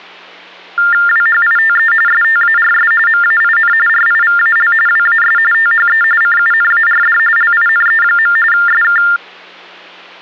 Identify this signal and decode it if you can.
TTY/TDD text telephone tones (45.45 baud Baudot), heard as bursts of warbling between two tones, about 400 Hz shift, 1600 Hz centre, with hum. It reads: WHITE STARS MAIN RIVAL WAS THE CUNARD LINE. SK